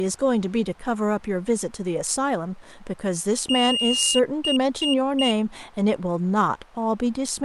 Beep code, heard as a piezo beeper, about 2850 Hz, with speech in English. 1 long, 3 short. In Award and IBM BIOS tables: video adapter failure; in AMI BIOS tables: memory failure.